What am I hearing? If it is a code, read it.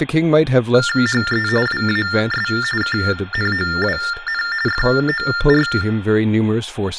TTY/TDD text telephone tones (45.45 baud Baudot), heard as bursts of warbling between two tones, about 400 Hz shift, 1600 Hz centre, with room echo and speech in English. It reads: HE WAS KNOWN FOR